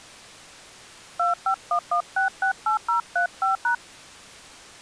DTMF, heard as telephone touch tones, dialled by hand, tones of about 110 ms. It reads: 2511668035#